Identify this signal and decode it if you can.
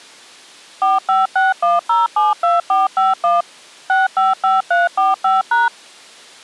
DTMF, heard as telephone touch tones, dialled by machine, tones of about 170 ms. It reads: 4561072451 655345#